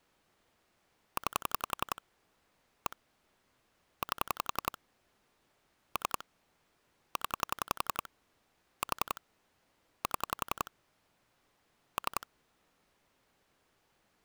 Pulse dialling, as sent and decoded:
9 / 1 / 8 / 3 / 10 / 4 / 7 / 3
9 1 8 3 0 4 7 3

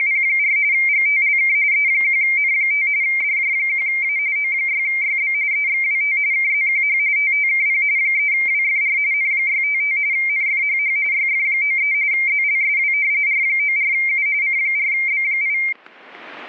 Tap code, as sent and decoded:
none

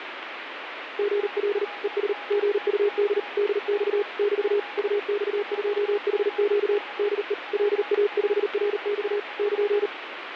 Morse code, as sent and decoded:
--. .-.. / . ... / --. ..- -.. / -.. -..- / -...- / ..- -..- ..--- .... --.- / -.. . / .-.. .- ..... .-. -..- / -.--.
GL ES GUD DX <BT> UX2HQ DE LA5RX <KN>

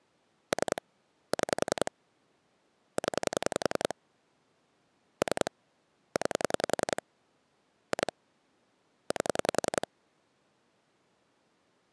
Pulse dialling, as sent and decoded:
3 / 6 / 10 / 3 / 9 / 2 / 8
3 6 0 3 9 2 8

